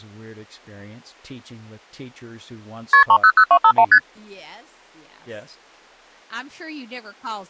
Multi-frequency trunk signalling (R1, as on North American trunks), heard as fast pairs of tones, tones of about 70 ms, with speech in English. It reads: KP 300251 ST